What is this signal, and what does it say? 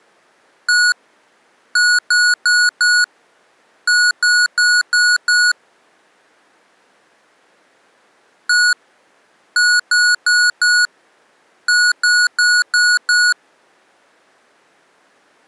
Beep code, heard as beeps from a small speaker, played twice, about 1460 Hz. 1-4-5.